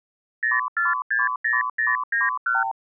Multi-frequency trunk signalling (R2, with the far end's replies), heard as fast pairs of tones, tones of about 170 ms. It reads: 0460091